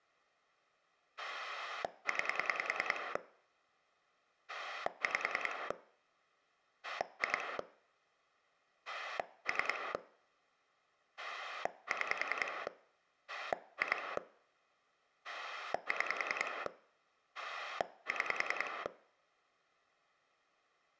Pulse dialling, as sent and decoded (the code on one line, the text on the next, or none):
9 / 5 / 2 / 3 / 6 / 2 / 6 / 6
9 5 2 3 6 2 6 6